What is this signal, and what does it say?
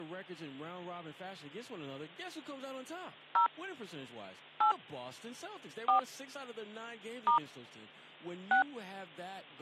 DTMF, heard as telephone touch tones, dialled by hand, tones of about 110 ms, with hum and speech in English. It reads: 0 8 4 * 6